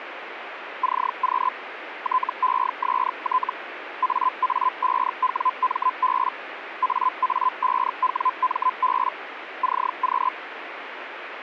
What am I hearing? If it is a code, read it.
Hellschreiber (Feld-Hell, 122.5 baud), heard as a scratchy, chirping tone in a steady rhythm, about 1020 Hz, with radio static. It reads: CQ TEST AA5WMB AA5WMB CQ